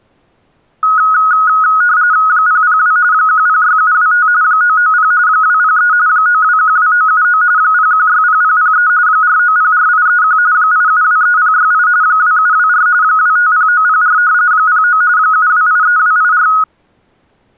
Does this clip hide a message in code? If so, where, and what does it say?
Yes: RTTY (45.45 baud, 170 Hz shift) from 0.8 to 16.6 s, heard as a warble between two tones, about 1360 Hz centre. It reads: 002 106725 990 203 9212979 0160003 4904831 8723068 2724 250904 09 7283284